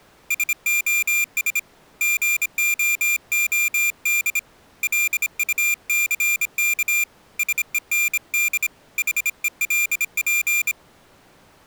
Morse code, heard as a high beeper, hand-sent with a bug key, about 26 wpm, 2400 Hz. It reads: SOS GOOD LUCK SEND HELP